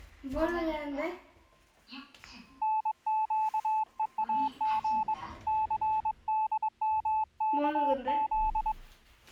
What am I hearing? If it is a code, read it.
Morse code, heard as a keyed tone, hand-sent with a paddle, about 22 wpm, 870 Hz, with the noise inside a lift. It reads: NQEAG CDMKZ